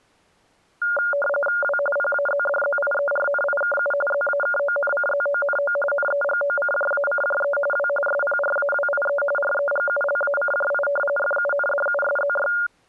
RTTY (45.45 baud, 850 Hz shift), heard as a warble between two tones, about 1000 Hz centre. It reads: W PAZDZIERNIKU ZAKONCZONO NEGOCJACJE W SPRAWIE REGULACJI FUNDUSZY